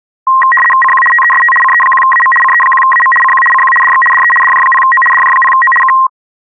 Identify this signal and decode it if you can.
RTTY (75 baud, 850 Hz shift), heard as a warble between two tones, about 1480 Hz centre. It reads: CQ TEST CE1AM CE1AM CQ CQ DX DE DJ0O DJ0O K